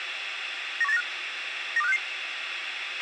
Five-tone selective call (EEA), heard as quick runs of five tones, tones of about 40 ms, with radio hiss, a squelch burst at the end and room echo. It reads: 91895 92566